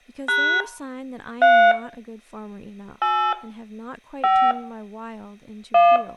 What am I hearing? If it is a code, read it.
DTMF, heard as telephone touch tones, dialled by hand, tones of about 280 ms, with room echo and speech in English. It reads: # 3 8 5 1